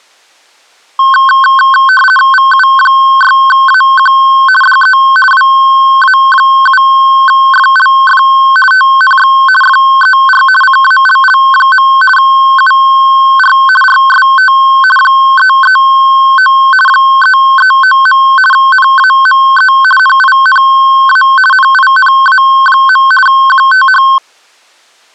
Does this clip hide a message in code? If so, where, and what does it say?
Yes: RTTY (50 baud, 450 Hz shift) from 1.0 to 24.2 s, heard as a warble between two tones, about 1300 Hz centre. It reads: VU6AQ DE WA7FLF TNX FER CALL. UR RST 339 339. NAME NINA NINA. QTH